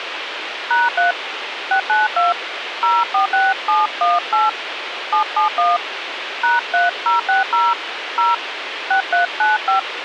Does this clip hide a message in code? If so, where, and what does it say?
Yes: DTMF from 0.7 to 9.8 s, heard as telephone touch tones, dialled by hand, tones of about 150 ms, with radio hiss. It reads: #3 692 046718 771 #3060 0 6395